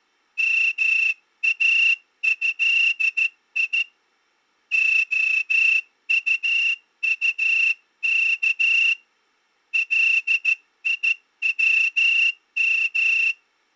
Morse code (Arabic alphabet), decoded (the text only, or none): ماهي خططك ليوم